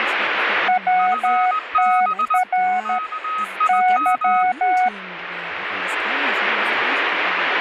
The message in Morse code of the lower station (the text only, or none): WTR Y